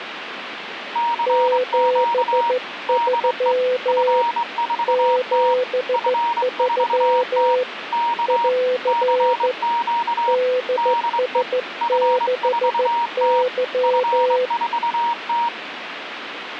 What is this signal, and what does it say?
Morse code, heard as two keyed tones, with radio static. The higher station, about 24 wpm, 940 Hz: CQ DE F4T F4T K CQ DE F4T F4T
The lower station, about 14 wpm, 500 Hz: 73 73 <AR> DS6Y